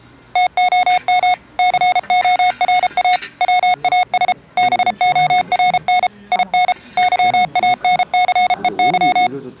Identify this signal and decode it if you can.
Morse code, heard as electronic beeps, machine-sent, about 33 wpm, 730 Hz, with the noise of a crowd indoors. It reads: TOM CORA WAS BORN IN YANCEY